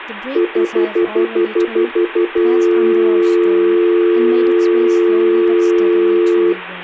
Telephone call progress tone (North American plan), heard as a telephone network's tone, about 350, 440 Hz, 0.1 s on and 0.1 s off, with hum and speech in English. Stutter dial tone.